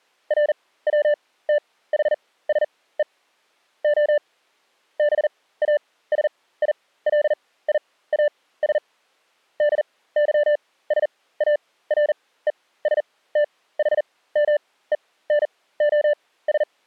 Morse code (Greek alphabet), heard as a keyed tone, machine-sent, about 40 wpm, spaced as for 19 wpm, 590 Hz. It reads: ΡΩΤΗΣΕ Ο ΒΑΣΙΛΙΑΣ ΔΥΣΑΡΕΣΤΗΜΕΝΟΣ